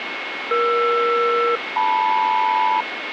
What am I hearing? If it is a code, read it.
Aircraft SELCAL, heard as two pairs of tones, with radio static and a steady whistle near 2180 Hz. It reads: ER-LM